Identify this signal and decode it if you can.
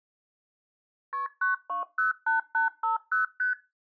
Multi-frequency trunk signalling (R1, as on North American trunks), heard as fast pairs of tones, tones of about 130 ms. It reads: KP 9208850 ST